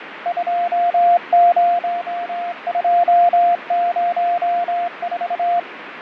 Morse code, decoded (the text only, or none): 20204